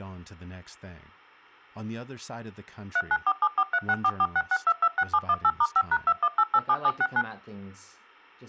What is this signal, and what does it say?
DTMF, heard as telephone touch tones, dialled by machine, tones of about 50 ms, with speech in English. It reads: 39474364466226718*5#21887769